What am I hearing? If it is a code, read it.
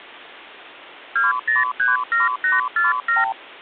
Multi-frequency trunk signalling (R2, with the far end's replies), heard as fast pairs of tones, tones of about 160 ms. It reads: 2037847